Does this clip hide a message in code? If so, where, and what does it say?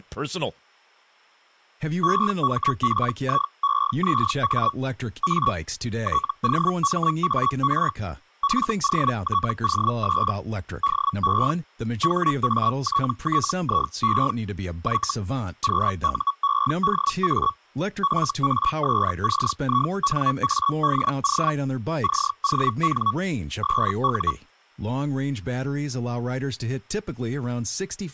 Yes: Hellschreiber (Feld-Hell, 122.5 baud) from 2.0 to 24.3 s, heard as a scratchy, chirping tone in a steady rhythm, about 1120 Hz, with speech in English. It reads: EMPIEZA A TOMAR FOTOS DE HATTIE Y QUEDA FASCINADO CON SU